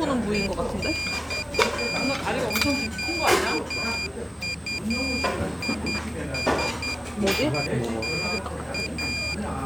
Morse code, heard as a high beeper, machine-sent, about 10 wpm, 2400 Hz, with the noise of a restaurant. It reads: EXQUISITA